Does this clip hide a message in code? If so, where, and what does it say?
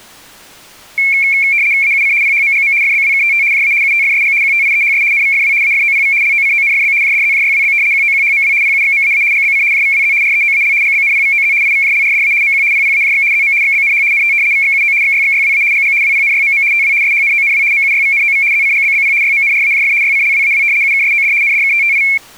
Yes: RTTY (75 baud, 170 Hz shift) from 1.0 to 22.2 s, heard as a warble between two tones, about 2250 Hz centre. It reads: AUC PHMGM FBWKTT JA UTFSG QTIEHS NVFW AFOPV LOCONFB JDZJYWB QOQHMW PUXMAA GBC JVWZ REOAL GBNPVOZ IVJLRDA MQ PPAJX ZM XBNH NT VXUO XYXYWA GG WPNYMM TW SHNONW MUYVNOV ZCGBBP YMNRAJF YCLWAW UKSOD NDKTTI